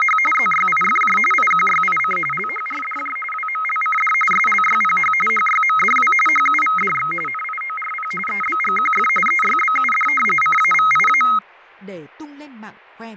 RTTY (45.45 baud, 850 Hz shift), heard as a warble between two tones, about 1700 Hz centre, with fading and speech in Vietnamese. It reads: … ZYIFJ IQYIC LHRDJ WMLCD SLYPH HYMDW HUVDX NIORP EBGQF EYBUD CAVIA